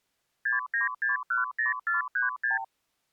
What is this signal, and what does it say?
Multi-frequency trunk signalling (R2, with the far end's replies), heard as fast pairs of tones, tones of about 140 ms. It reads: 69610436